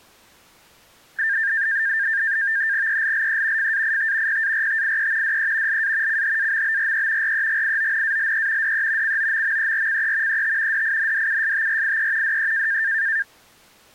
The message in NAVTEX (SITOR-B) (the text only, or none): ELLE FAIT PARTIE DE LA CHAMBRE REGIONALE DE COMMERCE ET DINDUSTRIE DE